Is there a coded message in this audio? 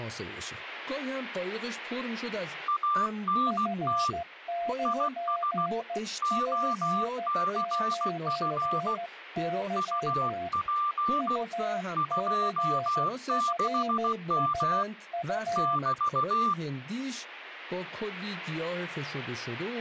Yes: Morse code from 2.6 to 16.6 s, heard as two keyed tones, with radio static and speech in Persian. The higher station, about 16 wpm, 1180 Hz: ANT IS OCF UP 26M <BT>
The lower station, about 14 wpm, 690 Hz: F9P9Y UCFSU